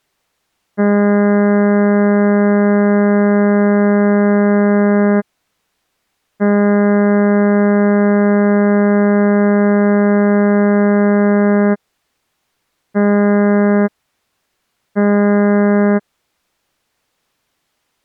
Ship horn signal, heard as a ship's horn, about 200 Hz. 2 long, 2 short. At sea: I intend to overtake on your port side.